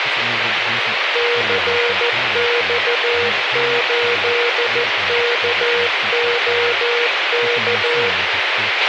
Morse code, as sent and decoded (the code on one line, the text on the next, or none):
-.-. -..- ---.. -.- --- -.-
CX8KOK